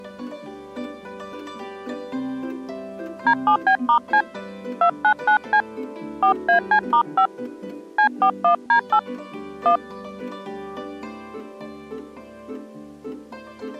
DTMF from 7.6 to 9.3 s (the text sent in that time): C41D8